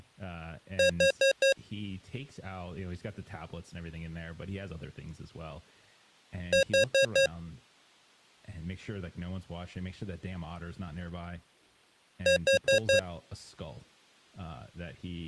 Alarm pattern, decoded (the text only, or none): temporal four